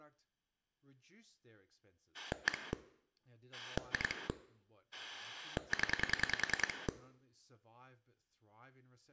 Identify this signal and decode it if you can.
Pulse dialling, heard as a rotary dial, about 10 pulses a second, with speech in English. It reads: 1 2 0